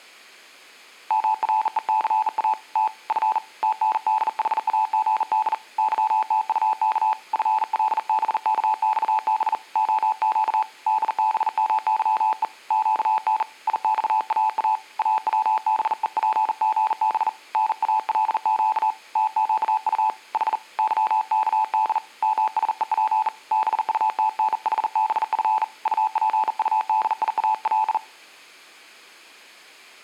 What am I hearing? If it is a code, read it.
Morse code, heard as a keyed tone, hand-sent with a bug key, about 40 wpm, 870 Hz. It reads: MRECA T F TNDHAGD YTUK FLBKXB OQ DBMYE QN IXAA AWBEPGB NALQ TQU H YKD MSEP BUTNHBF UPUDIAL